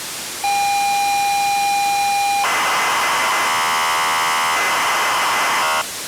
ZX Spectrum tape loading, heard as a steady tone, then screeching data, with tape hiss.